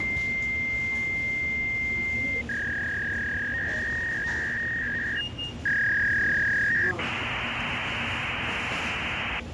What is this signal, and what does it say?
Fax machine handshake, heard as a long tone, a warble and hiss, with phone line noise and the noise of a subway station.